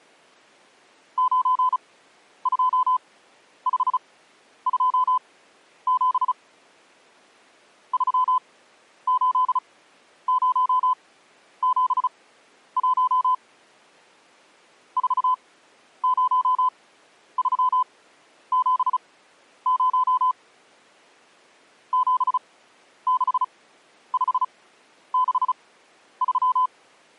Morse code, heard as a keyed tone, machine-sent, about 35 wpm, spaced as for 11 wpm, 1010 Hz. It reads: 92527 38071 40370 76563